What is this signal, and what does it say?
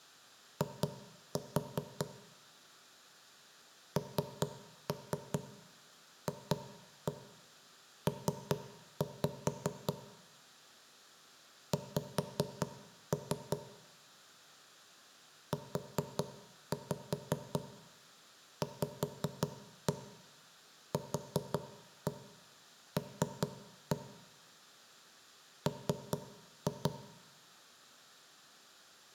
Tap code, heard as knocks on wood, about 5 knocks a second, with room echo. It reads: I NFP X UVQL M